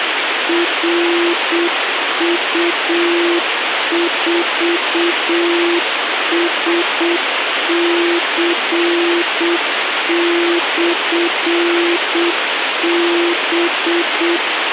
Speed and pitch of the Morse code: 7 wpm, 340 Hz

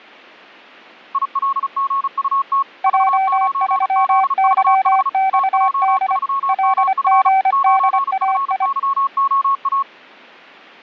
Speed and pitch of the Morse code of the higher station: 35 wpm, 1100 Hz

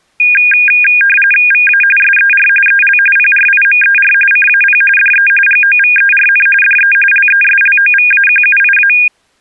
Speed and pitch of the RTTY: 45.45 baud, 850 Hz shift, 2050 Hz centre

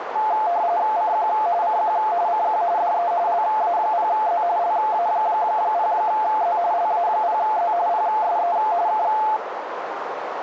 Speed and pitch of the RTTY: 45.45 baud, 170 Hz shift, 780 Hz centre

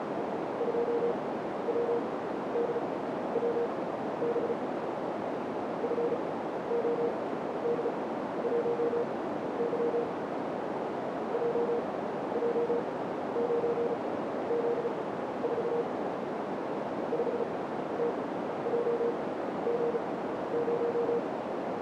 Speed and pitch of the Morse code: 35 wpm, spaced as for 13 wpm, 470 Hz

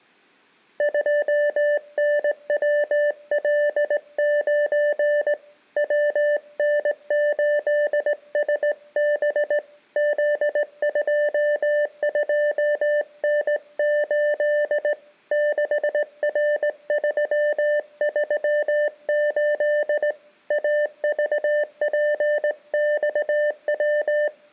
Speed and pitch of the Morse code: 18 wpm, 590 Hz

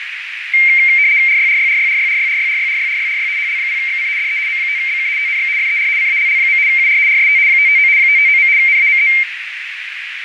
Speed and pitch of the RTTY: 75 baud, 170 Hz shift, 2200 Hz centre

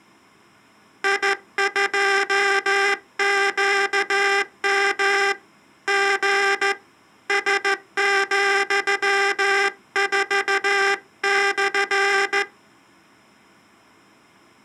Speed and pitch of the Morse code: 14 wpm

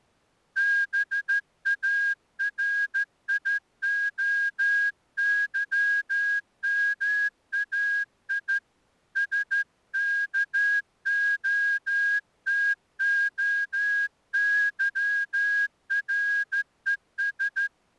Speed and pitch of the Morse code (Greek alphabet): 13 wpm

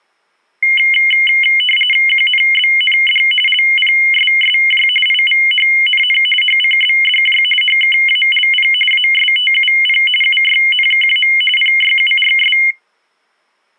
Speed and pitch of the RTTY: 45.45 baud, 850 Hz shift, 2550 Hz centre

